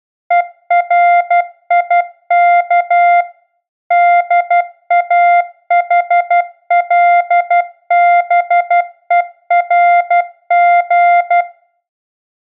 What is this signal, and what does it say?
Morse code, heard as a keyed tone, machine-sent, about 12 wpm, 700 Hz, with room echo. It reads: ERIK DAHLBERG